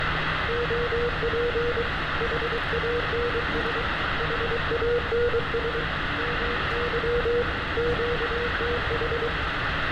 Morse code, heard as a keyed tone, hand-sent with a paddle, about 23 wpm, 480 Hz, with heavy radio static and street noise. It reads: OP HANS HANS MY QTH